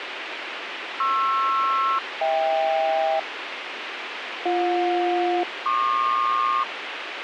Aircraft SELCAL, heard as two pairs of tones, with radio hiss. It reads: PR-HK BJ-PQ